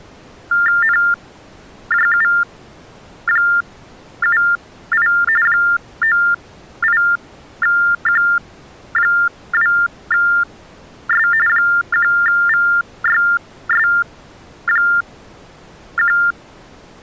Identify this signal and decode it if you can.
TTY/TDD text telephone tones (45.45 baud Baudot), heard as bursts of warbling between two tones, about 400 Hz shift, 1600 Hz centre. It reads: NJU78 98Q2S 1VYS1